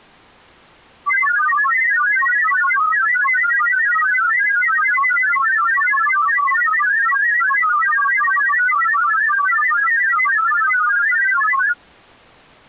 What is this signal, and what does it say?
Multi-tone FSK (Olivia or MFSK type), about 1000 Hz wide, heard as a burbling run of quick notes, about 31.25 baud.